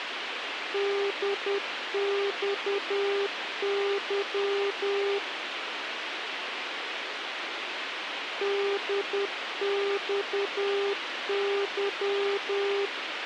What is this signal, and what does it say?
Morse code, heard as a keyed tone, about 10 wpm, 400 Hz, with radio hiss. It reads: DXY DXY